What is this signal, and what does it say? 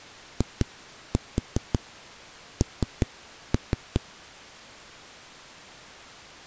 Tap code, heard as knocks on a wall, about 5 knocks a second. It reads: IN